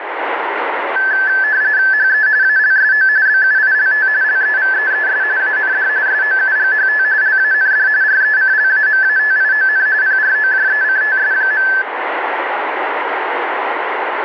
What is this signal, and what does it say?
RTTY (45.45 baud, 170 Hz shift), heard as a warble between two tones, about 1650 Hz centre, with radio static. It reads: HE ALSO BUILT LEVEES AND SOUGHT LAND RECLAMATION PROJECTS.